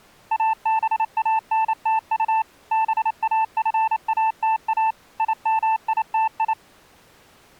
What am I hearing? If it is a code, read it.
Morse code, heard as a keyed tone, machine-sent, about 28 wpm, 880 Hz. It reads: ABANTU BAFATA IMITI